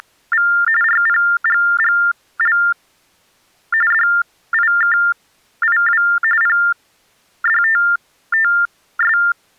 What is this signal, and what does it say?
TTY/TDD text telephone tones (45.45 baud Baudot), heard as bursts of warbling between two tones, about 400 Hz shift, 1600 Hz centre. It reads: … RPGGL DIKIW PDTTS